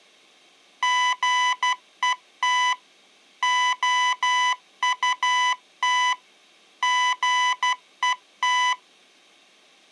Morse code, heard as electronic beeps, machine-sent, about 12 wpm, 1000 Hz. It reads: GET OUT GET